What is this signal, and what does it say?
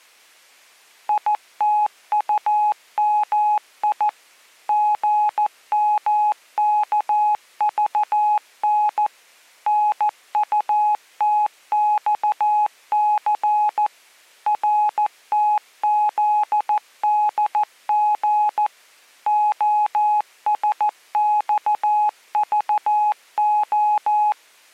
Morse code, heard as a keyed tone, machine-sent, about 14 wpm, 840 Hz. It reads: ITUMI GMKVN NUTXC RTZDG OSXVO